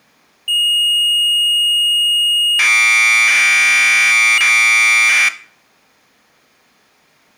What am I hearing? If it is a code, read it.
Commodore tape loading (standard loader), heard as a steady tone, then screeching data, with room echo.